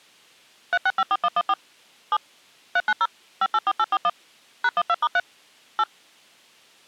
DTMF, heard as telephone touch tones, dialled by machine, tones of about 50 ms. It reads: 3654114 7 390 584841 #12*3 8